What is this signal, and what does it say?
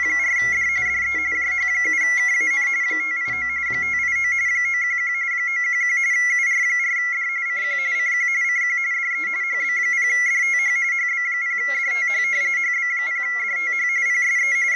RTTY (45.45 baud, 170 Hz shift), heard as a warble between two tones, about 2050 Hz centre, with a steady whistle near 1370 Hz. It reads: … DE JH7KAN 589 589 911 911 UR4D CQ CQ CQ DE HB0DTH HB0DTH HB0DTH PSE …